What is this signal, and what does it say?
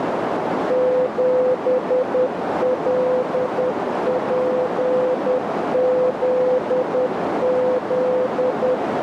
Morse code, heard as a keyed tone, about 10 wpm, 510 Hz, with heavy radio static and a narrow filter. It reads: 7LPZZ